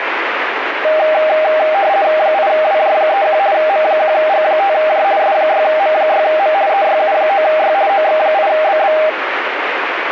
RTTY (50 baud, 170 Hz shift), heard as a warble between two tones, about 710 Hz centre, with radio static. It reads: 8WJ31 M1G5J S6M6M EYU9Y OX8BB